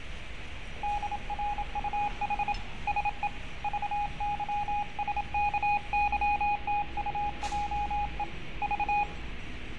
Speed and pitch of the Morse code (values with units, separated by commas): 27 wpm, 830 Hz